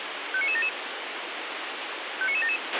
Five-tone selective call (ZVEI), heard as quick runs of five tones, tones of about 70 ms, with radio hiss and a squelch burst at the end. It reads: 59977 59977